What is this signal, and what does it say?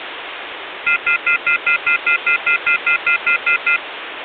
Telephone call progress tone (North American plan), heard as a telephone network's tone, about 1400, 2050, 2450, 2600 Hz, 0.1 s on and 0.1 s off, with phone line noise. Off-hook warning tone.